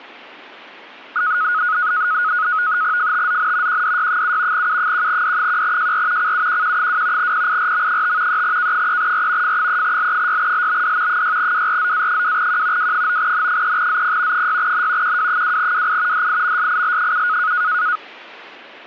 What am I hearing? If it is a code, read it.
NAVTEX (SITOR-B), 100 baud, 170 Hz shift, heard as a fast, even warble, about 1360 Hz centre. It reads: FTZN QDY7 U1D1JR CUQQ2 PIRM5 3K3R F3L6LBD 6WRZA2Q W9N3ZP 6N QW2WI DIMSIL7